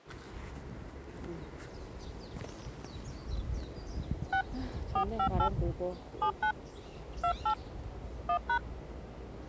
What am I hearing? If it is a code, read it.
DTMF, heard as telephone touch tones, dialled by hand, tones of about 90 ms, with the noise of a park. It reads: 6 458 79 28 1#